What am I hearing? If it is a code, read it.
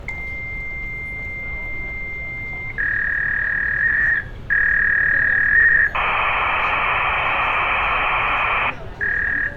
Fax machine handshake, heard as a long tone, a warble and hiss, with room echo and street noise.